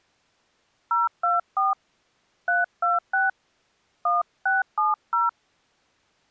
DTMF, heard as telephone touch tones, dialled by hand, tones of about 170 ms. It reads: 024 326 1670